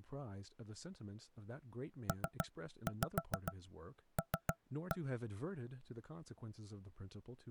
Tap code, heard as knocks on wood, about 6 knocks a second, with speech in English. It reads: PL